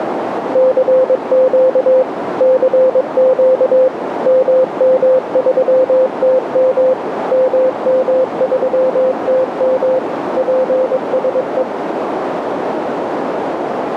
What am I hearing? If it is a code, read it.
Morse code, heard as a keyed tone, machine-sent, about 22 wpm, 520 Hz, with heavy radio static and a narrow filter. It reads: CQ CQ MM3TM MM3TM PSE